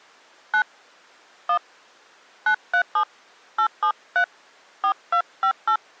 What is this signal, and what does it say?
DTMF, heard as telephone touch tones, dialled by hand, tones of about 80 ms. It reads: 9 1 937 873 4258